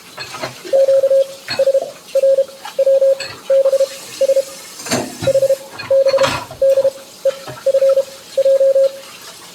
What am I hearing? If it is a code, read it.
Morse code, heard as a keyed tone, machine-sent, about 32 wpm, spaced as for 17 wpm, 540 Hz, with kitchen noise. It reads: QSRWBS HBDEFJ